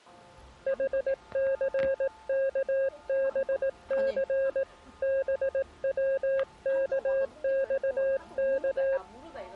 Morse code, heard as a keyed tone, hand-sent with a paddle, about 18 wpm, 540 Hz, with the noise of a restaurant. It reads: HCKBC BWKXK